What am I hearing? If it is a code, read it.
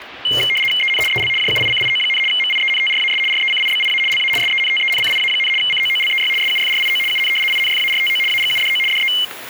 RTTY (75 baud, 850 Hz shift), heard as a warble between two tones, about 2550 Hz centre, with kitchen noise. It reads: EN EL JUICIO, MIENTRAS RECIBIA LA SENTENCIA, COOLEY SUFRIO UN INFARTO AGUDO DE